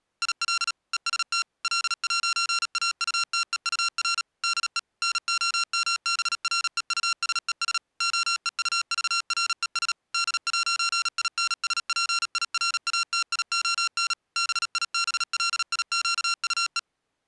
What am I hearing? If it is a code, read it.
Morse code, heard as electronic beeps, machine-sent, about 37 wpm, 1370 Hz. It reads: IL EST L'AUTEUR DE NOMBREUSES OEUVRES D'INSPIRATION BIBLIQUE